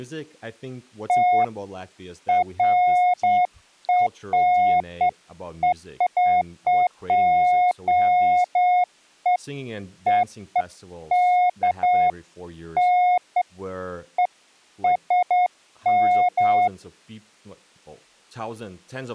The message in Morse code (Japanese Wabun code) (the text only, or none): none